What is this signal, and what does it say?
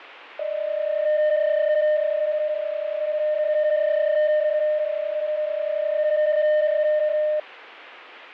PSK31 (31.25 baud), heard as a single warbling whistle, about 610 Hz, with fading.